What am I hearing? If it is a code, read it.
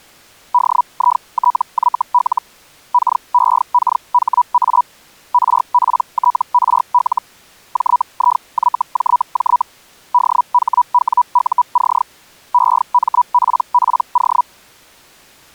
Hellschreiber (Feld-Hell, 122.5 baud), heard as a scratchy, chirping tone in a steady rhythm, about 980 Hz. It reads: DITYL KEKHA RPTRL JIYJJ DHWUC EMPPO